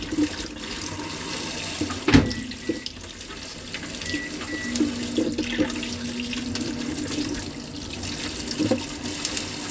Kitchen noise. There is no code.